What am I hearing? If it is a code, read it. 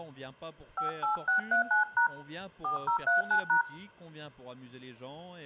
DTMF, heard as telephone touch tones, dialled by hand, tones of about 120 ms, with room echo. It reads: 58639# 4039#